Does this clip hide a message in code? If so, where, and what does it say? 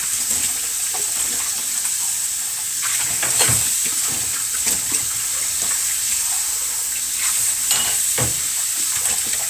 No, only kitchen noise.